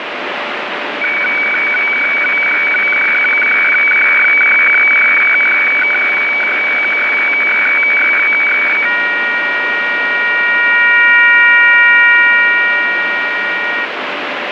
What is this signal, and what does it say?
Weather fax (radiofax), 120 lines a minute, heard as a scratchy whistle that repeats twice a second, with heavy radio static.